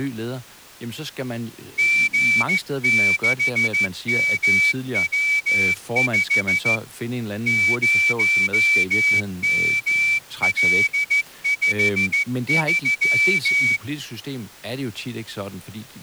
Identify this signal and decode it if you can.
Morse code, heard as a whistle, hand-sent with a straight key, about 14 wpm, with speech in Danish. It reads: G6MW5 0ML53